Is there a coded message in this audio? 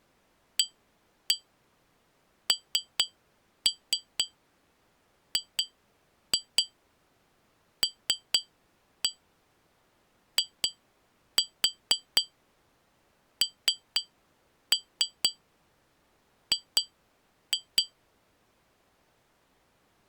Yes: tap code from 0.6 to 17.9 s, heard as taps on glass, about 4 knocks a second. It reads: ANGLING